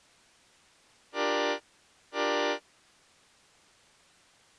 Train horn signal, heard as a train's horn. 2 short. On North American railways: a signal is acknowledged.